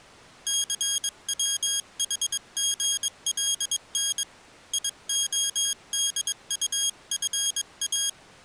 Morse code, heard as a high beeper, hand-sent with a paddle, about 22 wpm, 3250 Hz. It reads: CWHGLN IODUFA